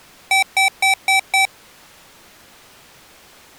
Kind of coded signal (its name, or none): beep code